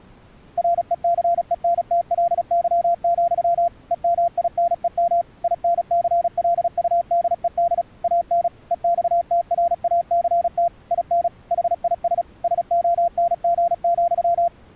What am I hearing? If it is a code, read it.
Morse code, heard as a keyed tone, machine-sent, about 36 wpm, 690 Hz. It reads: RECENTLY, EMINEM INCLUDED AN EXTRACT IN HIS SONG,